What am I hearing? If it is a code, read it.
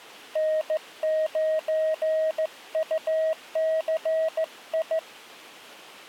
Morse code, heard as a keyed tone, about 15 wpm, 630 Hz. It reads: N9UCI